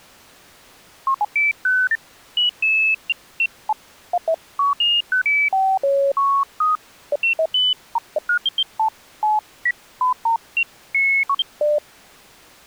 Electronic bleeps of random pitch and length. There is no code.